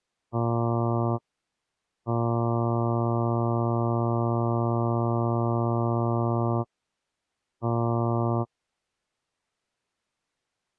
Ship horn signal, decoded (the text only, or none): 1 short, 1 long, 1 short